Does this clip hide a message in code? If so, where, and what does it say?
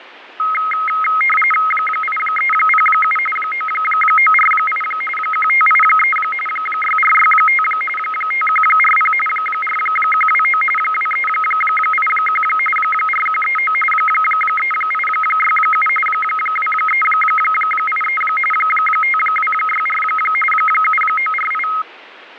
Yes: RTTY (45.45 baud, 850 Hz shift) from 0.4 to 21.8 s, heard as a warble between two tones, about 1700 Hz centre, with radio static and fading. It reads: 8307 9948 1583 6465 5140 4129 2381 4139 3867 2383 5264 7948